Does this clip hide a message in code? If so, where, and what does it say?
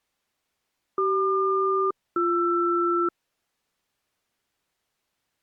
Yes: aircraft SELCAL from 1.0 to 3.1 s, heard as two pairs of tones. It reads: CQ-BR